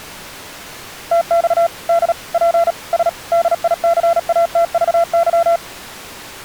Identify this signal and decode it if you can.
Morse code, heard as a keyed tone, machine-sent, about 37 wpm, 680 Hz. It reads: TX D P S DICATVY